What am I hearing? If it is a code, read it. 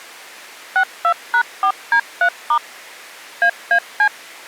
DTMF, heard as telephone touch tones, dialled by machine, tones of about 80 ms. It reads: 62#4D3* AAC